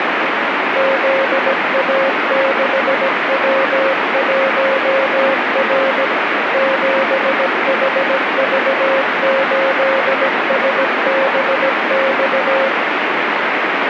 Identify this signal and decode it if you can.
Morse code, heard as a keyed tone, machine-sent, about 17 wpm, 540 Hz, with heavy radio static. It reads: ZA6W1R 7HV8SBX